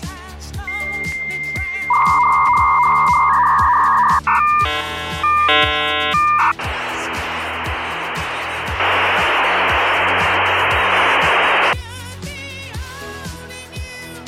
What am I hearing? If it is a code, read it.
Dial-up modem handshake (V.34 or later), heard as a whistle, warbles, then hiss.